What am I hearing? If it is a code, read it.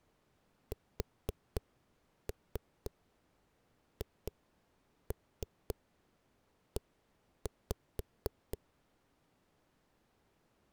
Tap code, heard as knocks on a wall, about 4 knocks a second. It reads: SHE